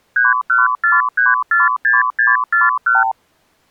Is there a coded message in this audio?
Yes: multi-frequency trunk signalling (R2, with the far end's replies) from 0.2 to 3.1 s, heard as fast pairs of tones, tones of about 170 ms. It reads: 314346641